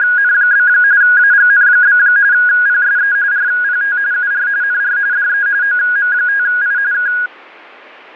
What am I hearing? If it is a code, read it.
RTTY (45.45 baud, 170 Hz shift), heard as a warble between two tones, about 1550 Hz centre. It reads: … AGN? PSE RPT UR NR DE OM5I K